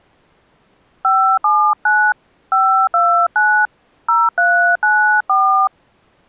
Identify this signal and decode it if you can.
DTMF, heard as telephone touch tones, dialled by hand, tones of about 290 ms. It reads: 579 529 0394